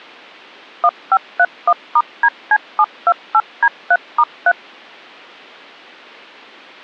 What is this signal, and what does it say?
DTMF, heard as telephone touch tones, dialled by machine, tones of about 60 ms. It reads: 1531*DC728D3*3